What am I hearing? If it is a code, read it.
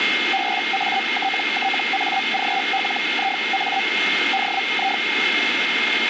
Hellschreiber (Feld-Hell, 122.5 baud), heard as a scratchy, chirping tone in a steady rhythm, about 780 Hz, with radio static and a steady whistle near 2130 Hz. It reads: BATTAGLIA DI